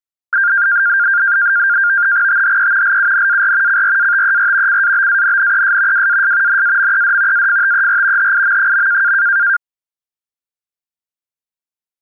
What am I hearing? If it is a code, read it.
NAVTEX (SITOR-B), 100 baud, 170 Hz shift, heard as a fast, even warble, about 1500 Hz centre. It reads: THE LUNAR CRATER CABANNES WAS NAMED AFTER HIM.